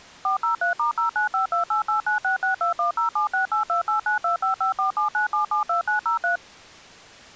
DTMF, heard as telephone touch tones, dialled by machine, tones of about 120 ms. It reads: 403*095288966210768289255479772903